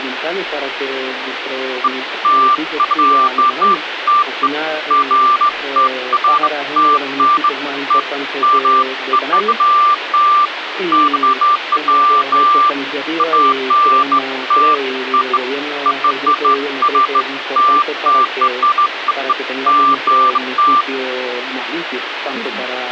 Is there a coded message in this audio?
No, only beeps of irregular length, with phone line noise.